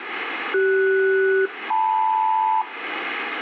Aircraft SELCAL, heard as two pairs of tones, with radio static. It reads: CS-LM